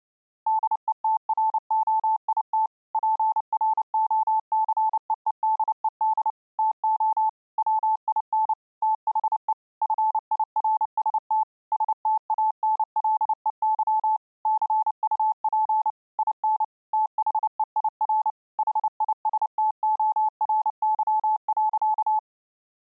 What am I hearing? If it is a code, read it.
Morse code, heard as a keyed tone, machine-sent, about 29 wpm, 870 Hz. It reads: DETROIT PROCEEDED TO WIN THE FIRST STANLEY CUP IN THEIR HISTORY.